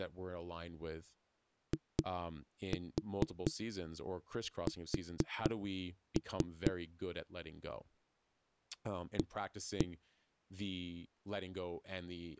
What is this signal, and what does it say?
Tap code, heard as knocks on a wall, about 4 knocks a second, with speech in English. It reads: IS A